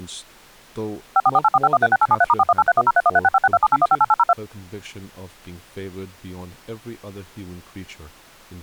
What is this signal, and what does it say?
DTMF, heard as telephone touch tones, dialled by machine, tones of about 40 ms, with speech in English. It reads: 544845136873*418310313656278158802